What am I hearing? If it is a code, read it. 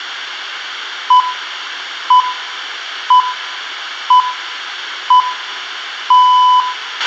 Radio time signal (six pips, as the Greenwich Time Signal), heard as pips, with a squelch burst at the end and room echo.